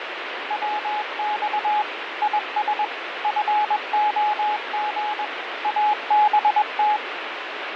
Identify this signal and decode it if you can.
Morse code, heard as a keyed tone, machine-sent, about 21 wpm, 840 Hz, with radio static and fading. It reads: WX IS FOG ABT